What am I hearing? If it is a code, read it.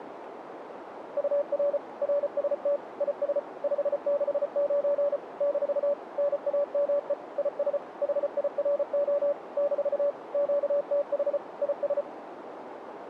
Morse code, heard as a keyed tone, machine-sent, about 34 wpm, 570 Hz, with radio static and a narrow filter. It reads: UR RST IS 569 - NAME IS HIRO - QTH IS